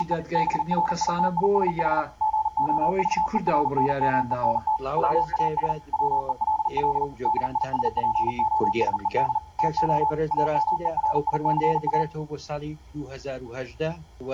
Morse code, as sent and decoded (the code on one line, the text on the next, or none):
… / -... .-. .. - .. ... .... / --. --- ...- . .-. -. -- . -. - / .-- .- ... / .-- . .-.. .-.. / -.. .. ... .--. --- ... . -.. / - --- / .- -- . .-. .. -.-. .-
… BRITISH GOVERNMENT WAS WELL DISPOSED TO AMERICA